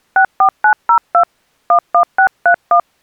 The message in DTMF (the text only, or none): 64902 11631